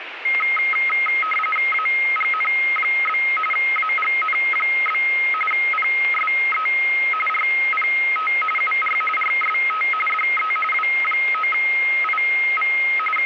RTTY (45.45 baud, 850 Hz shift), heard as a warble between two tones, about 1700 Hz centre, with radio static. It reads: AGN? AGN? PSE RPT UR RST DE W9IV …